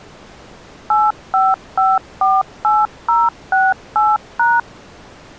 DTMF, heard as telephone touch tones, dialled by machine, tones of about 200 ms. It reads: 85548068#